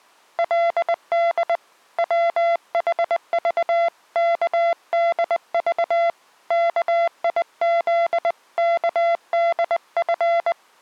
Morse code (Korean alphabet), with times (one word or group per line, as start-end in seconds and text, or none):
0.4-1.6 그
2.0-6.1 불을
6.5-10.5 얕은